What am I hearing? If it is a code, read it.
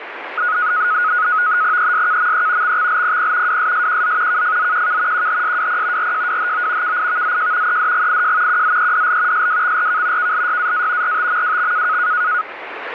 NAVTEX (SITOR-B), 100 baud, 170 Hz shift, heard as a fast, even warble, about 1360 Hz centre, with radio static. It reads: ESKME XXLPP WSSQZ KFZQK QHSWP RJWHO KIVZJ EDGIJ QZEDL SWXRK KLYAA RTMWX